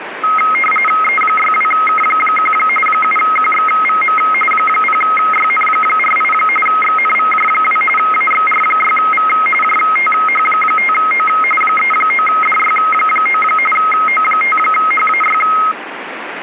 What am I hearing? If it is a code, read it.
RTTY (45.45 baud, 850 Hz shift), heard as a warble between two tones, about 1700 Hz centre, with radio static. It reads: E62K1 7QXVM 0YN48 XNVJ2 AXR6V JTH5O 39DY9 O5HAY